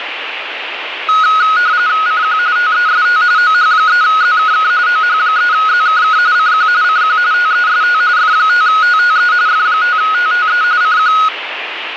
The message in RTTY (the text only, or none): CQ TEST OH3ZKK OH3ZKK CQ CQ TEST F5TTE F5TTE CQ